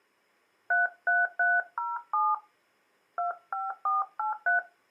DTMF, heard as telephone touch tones, dialled by hand, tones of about 170 ms. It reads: 33307 25483